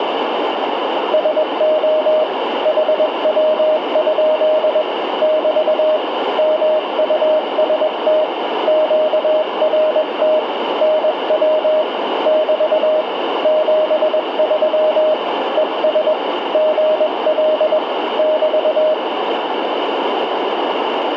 Morse code, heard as a keyed tone, hand-sent with a paddle, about 21 wpm, 620 Hz, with radio static. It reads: SO HW? <BT> MUST QRT NW <BT> 73 ES GL <BT>